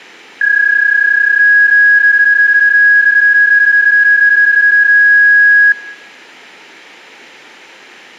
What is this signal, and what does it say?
PSK31 (31.25 baud), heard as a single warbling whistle, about 1650 Hz, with room echo.